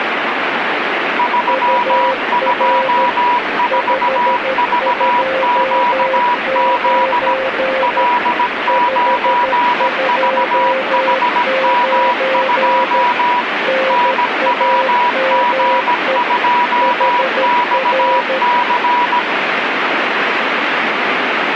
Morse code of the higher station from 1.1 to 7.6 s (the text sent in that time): 324VQZ